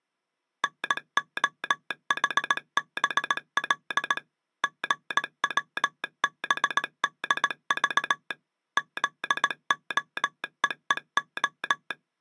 Morse code, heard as a telegraph sounder, machine-sent, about 18 wpm. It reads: NOHBL GWBDV ZOEEO